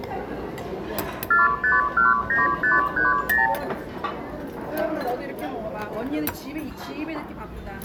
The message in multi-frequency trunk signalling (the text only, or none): 4519530